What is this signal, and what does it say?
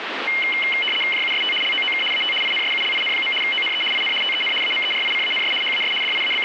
RTTY (75 baud, 850 Hz shift), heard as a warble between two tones, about 2550 Hz centre, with radio static. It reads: JUST LOOK AT INSULIN. ONE IN TEN AMERICANS HAS …